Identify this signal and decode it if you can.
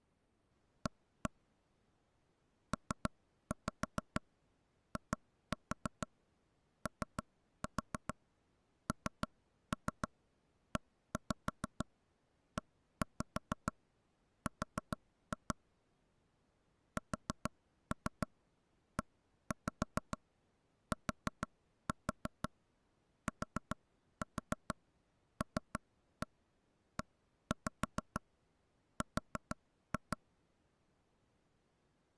Tap code, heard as taps on a table, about 6 knocks a second. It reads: A PIONEER SETTLER